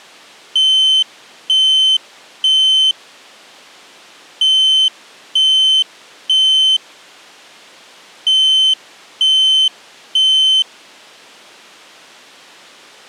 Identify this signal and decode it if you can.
Alarm pattern, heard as an alarm's beeps, played three times, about 3050 Hz. Temporal three. Smoke or fire, evacuate.